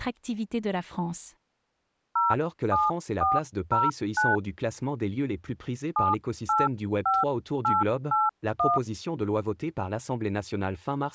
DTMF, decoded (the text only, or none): 07409 785881